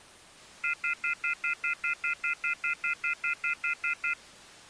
Telephone call progress tone (North American plan), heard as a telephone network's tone, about 1400, 2050, 2450, 2600 Hz, 0.1 s on and 0.1 s off. Off-hook warning tone.